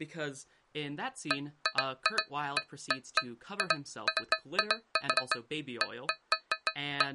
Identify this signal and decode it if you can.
Irregular taps on a metal pipe, with speech in English. There is no code.